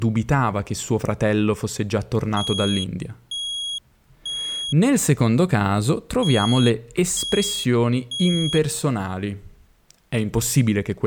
Alarm pattern, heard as an alarm's beeps, played twice, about 3300 Hz, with speech in Italian. Temporal three. Smoke or fire, evacuate.